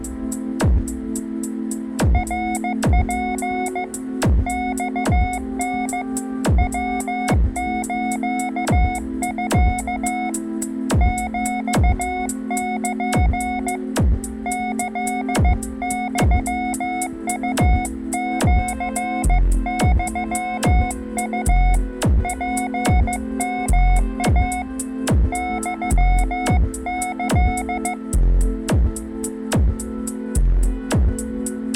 Morse code (Japanese Wabun code), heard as a keyed tone, hand-sent with a paddle, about 15 wpm, 730 Hz. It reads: ナツ マタ ヤスミ ヒル キユウシユウ ツヨイ ユキ